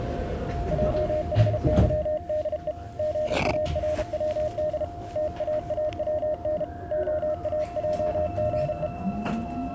Morse code, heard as a keyed tone, hand-sent with a paddle, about 33 wpm, 610 Hz, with the noise inside a subway train. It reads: JHYDE GARWD TAAWN OAJGE